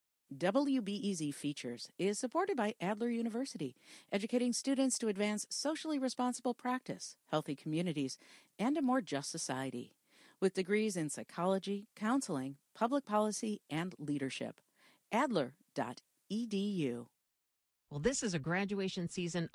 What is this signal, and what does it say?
Speech in English. There is no code.